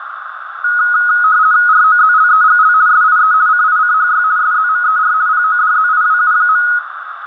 RTTY (50 baud, 170 Hz shift), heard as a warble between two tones, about 1360 Hz centre, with radio static, a narrow filter and room echo. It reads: ROZLEGL SIE CICHY SZMER PODZIWU.